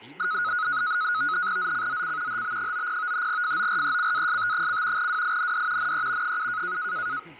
NAVTEX (SITOR-B), 100 baud, 170 Hz shift, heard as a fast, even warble, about 1360 Hz centre, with speech in Malayalam. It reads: ZCZC HB90 FORECAST: WIND NE 7